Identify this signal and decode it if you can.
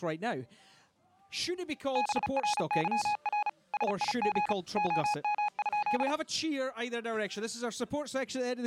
Morse code, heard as a keyed tone, machine-sent, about 35 wpm, 840 Hz. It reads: BRYR SIG OM?